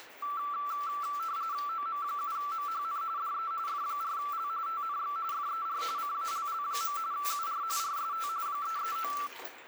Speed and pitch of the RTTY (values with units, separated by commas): 45.45 baud, 170 Hz shift, 1240 Hz centre